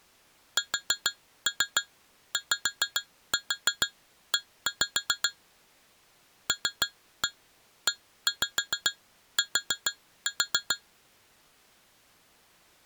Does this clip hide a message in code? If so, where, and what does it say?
Yes: tap code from 0.6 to 10.8 s, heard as taps on glass, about 6 knocks a second. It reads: SYE LET